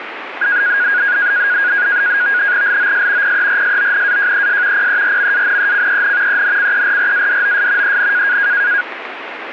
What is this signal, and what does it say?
NAVTEX (SITOR-B), 100 baud, 170 Hz shift, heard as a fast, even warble, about 1550 Hz centre, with radio static. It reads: LOS PERSONAJES PERMANECEN ENCERRADOS EN